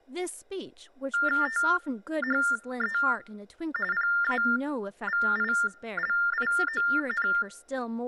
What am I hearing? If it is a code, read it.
TTY/TDD text telephone tones (45.45 baud Baudot), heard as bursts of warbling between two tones, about 400 Hz shift, 1600 Hz centre, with speech in English. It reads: THE PAVILION